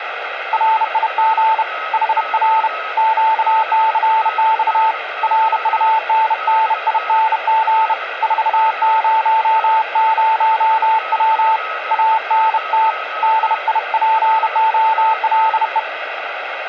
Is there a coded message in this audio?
Yes: Morse code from 0.5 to 15.9 s, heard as a keyed tone, hand-sent with a bug key, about 31 wpm, 890 Hz, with radio static and a weaker station near 1280 Hz. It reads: RIG HR QCX RUNNING 400W ANT DIPOLE